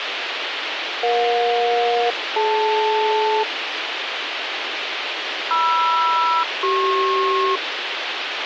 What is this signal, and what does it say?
Aircraft SELCAL, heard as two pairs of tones, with radio hiss. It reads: EJ-DL MR-CP